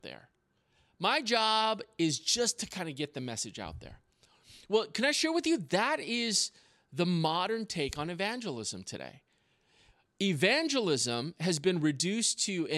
Speech in English. There is no code.